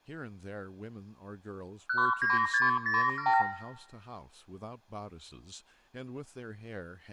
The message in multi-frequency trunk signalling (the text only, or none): 19607